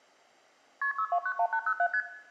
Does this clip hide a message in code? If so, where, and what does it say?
Yes: multi-frequency trunk signalling (R1, as on North American trunks) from 0.8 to 2.0 s, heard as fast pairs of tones, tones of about 70 ms, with room echo. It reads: KP 6291807 ST